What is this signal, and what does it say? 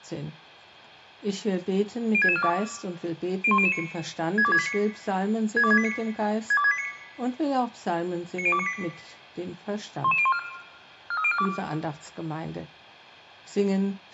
Five-tone selective call (ZVEI), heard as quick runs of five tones, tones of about 70 ms, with room echo. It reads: 06642 01009 62689 62689 62689 90298 11014 43042